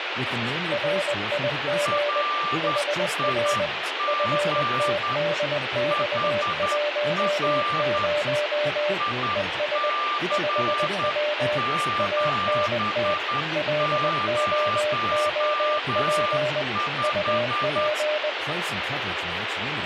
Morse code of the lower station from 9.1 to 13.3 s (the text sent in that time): ES 5W ANT